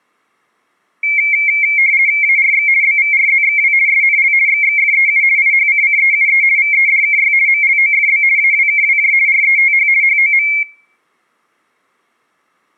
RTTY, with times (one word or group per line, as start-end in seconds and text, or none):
2.2-2.7 ARX
2.8-3.7 BVRZXW
3.9-4.3 SNL
4.5-5.2 XXFEU
5.4-6.4 IHCCEUE
6.6-7.3 VEDKY
7.5-8.2 MLOFB
8.4-9.1 AWKWJ
9.3-9.9 RETH
10.0-10.5 HOM